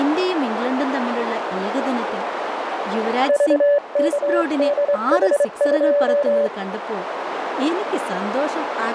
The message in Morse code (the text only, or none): VKDH2